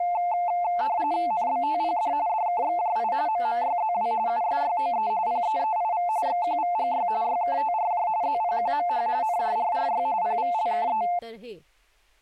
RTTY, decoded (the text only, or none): NBTPD DKXJI MMYZW USYOE PEEIV XQVGY YKTRJ ZPQMH NJRRY PVLKE